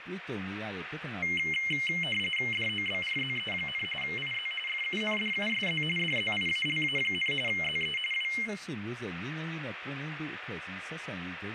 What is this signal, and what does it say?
RTTY (45.45 baud, 850 Hz shift), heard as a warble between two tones, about 2550 Hz centre, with radio static and room echo. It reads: DOBRZE, IZ FUNDUSZ DZIALA, ZE W